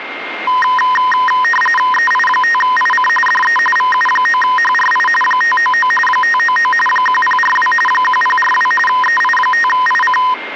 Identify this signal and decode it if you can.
RTTY (45.45 baud, 850 Hz shift), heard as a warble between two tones, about 1440 Hz centre, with radio static and a steady whistle near 2120 Hz. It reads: EI5IC DE VU9HRI 599 599 1042 1042 EI5IC